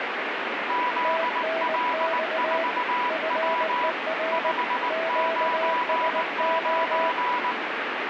Morse code, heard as two keyed tones, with radio static. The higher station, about 19 wpm, 980 Hz: ZL4W 599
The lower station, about 19 wpm, 660 Hz: TNX FER QSO